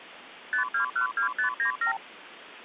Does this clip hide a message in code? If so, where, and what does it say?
Yes: multi-frequency trunk signalling (R2, with the far end's replies) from 0.5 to 2.0 s, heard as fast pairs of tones, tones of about 110 ms, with phone line noise. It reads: 5212597